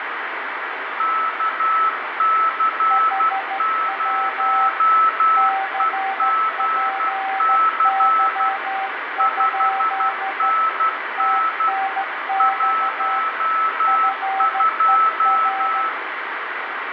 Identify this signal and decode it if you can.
Morse code, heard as two keyed tones, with radio static and room echo. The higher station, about 12 wpm, 1310 Hz: KC0EGC 5NN 12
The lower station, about 14 wpm, 780 Hz: HW CPY? TNX FER